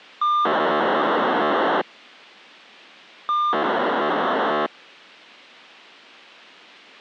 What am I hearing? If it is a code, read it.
POCSAG pager data (2400 baud), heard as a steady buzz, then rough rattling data.